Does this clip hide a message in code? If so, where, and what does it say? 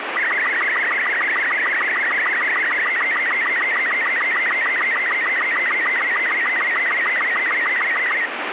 Yes: SSTV (slow-scan television), Robot 36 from 0.2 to 8.3 s, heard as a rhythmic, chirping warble, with radio static.